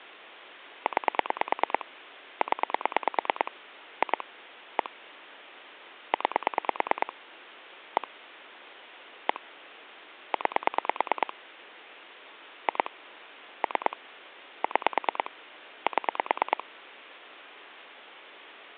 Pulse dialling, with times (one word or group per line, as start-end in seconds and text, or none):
0.9-1.9 9
2.4-3.5 0
4.0-4.2 2
4.8-4.9 1
6.1-7.1 9
8.0-8.1 1
9.3-9.4 1
10.3-11.3 9
12.7-12.9 2
13.6-14.0 3
14.6-15.3 6
15.9-16.6 7